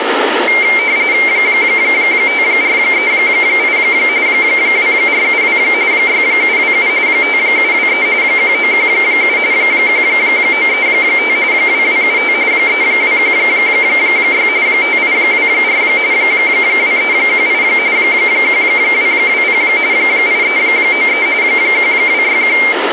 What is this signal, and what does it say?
RTTY (45.45 baud, 170 Hz shift), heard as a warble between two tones, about 2200 Hz centre, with radio static. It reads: 5438 2472 6727 5723 1917 1935 2275 3216 5824 2318 1220 8393 1261